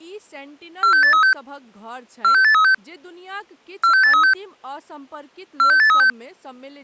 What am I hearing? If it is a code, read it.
Five-tone selective call (CCIR), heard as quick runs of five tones, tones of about 100 ms, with speech in Maithili. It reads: 46836 46836 46836 46836